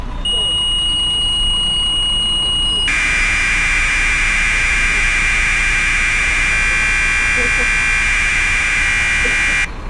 Commodore tape loading (standard loader), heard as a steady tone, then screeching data, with street noise.